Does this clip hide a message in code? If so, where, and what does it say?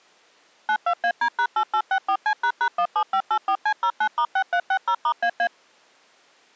Yes: DTMF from 0.7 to 5.5 s, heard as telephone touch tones, dialled by machine, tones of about 70 ms. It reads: 92AD#8864C##17584C09*6360*AA